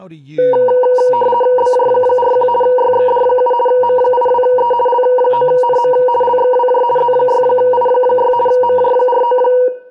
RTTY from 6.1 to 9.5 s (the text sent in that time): LXWJ Z6I6 MJ49